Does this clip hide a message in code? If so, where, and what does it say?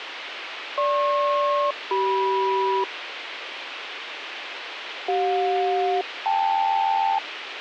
Yes: aircraft SELCAL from 0.8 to 7.2 s, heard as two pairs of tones, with radio hiss. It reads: GP-CM CJ-KL